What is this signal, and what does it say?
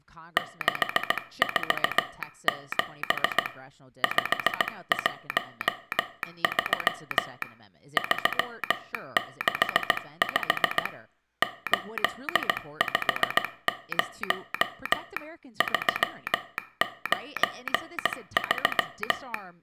Morse code, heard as a telegraph sounder, hand-sent with a paddle, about 17 wpm, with room echo and speech in English. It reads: 647 513 365 850 393